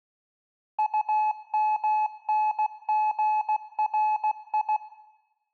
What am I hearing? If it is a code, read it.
Morse code, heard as a keyed tone, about 16 wpm, 860 Hz, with room echo. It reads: UMNGRI